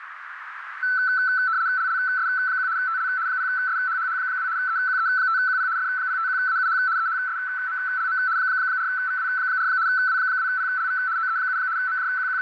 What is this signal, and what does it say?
RTTY (75 baud, 170 Hz shift), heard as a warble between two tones, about 1420 Hz centre, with radio static and a narrow filter. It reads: LLS1 TL 0SHHH2 EQE5QP F051AUH EHSMLM 4VW4 W2PLV OE7 …